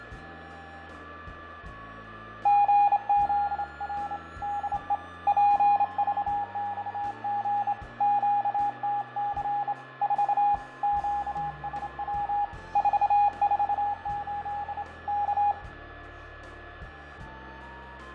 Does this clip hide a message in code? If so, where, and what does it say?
Yes: Morse code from 2.4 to 15.6 s, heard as a keyed tone, hand-sent with a straight key, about 27 wpm, 820 Hz, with radio static, fading, a steady whistle near 1720 Hz and room echo. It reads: GZR DE PVXG QTC 4 QSW 448 K